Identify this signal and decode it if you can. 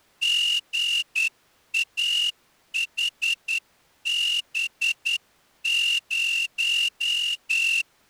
Morse code, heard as a whistle, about 10 wpm. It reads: GAHB0